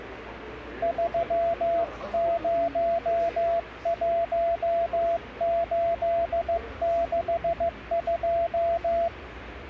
Morse code, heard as a keyed tone, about 15 wpm, 680 Hz, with the noise of a subway station. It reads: 301862